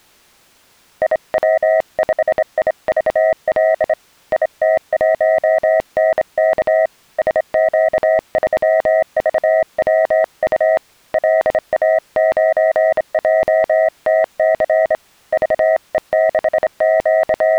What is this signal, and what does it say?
Morse code, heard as a keyed tone, hand-sent with a straight key, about 26 wpm, 640 Hz. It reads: IW5IVL IT1NK SQ3VWU LA9JTC …